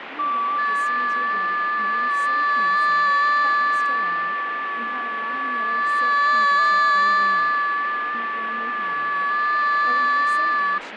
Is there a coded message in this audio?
Yes: FT8 (several signals at once) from 0.2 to 10.8 s, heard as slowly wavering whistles, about 6.25 baud, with radio static, fading and speech in English.